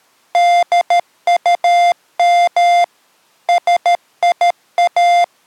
Morse code, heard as electronic beeps, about 13 wpm, 700 Hz. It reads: DUM SIA